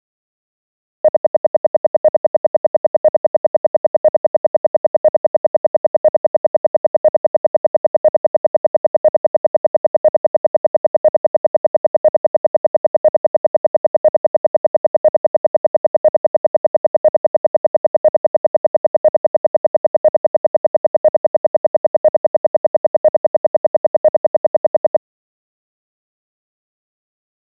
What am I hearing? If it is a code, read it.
Radio time signal (RWM, Moscow), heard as ten pulses a second.